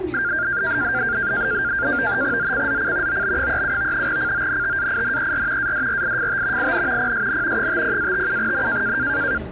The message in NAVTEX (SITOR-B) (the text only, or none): ZCZC OB37 CONTAINER ADRIFT IN PSN 50-57N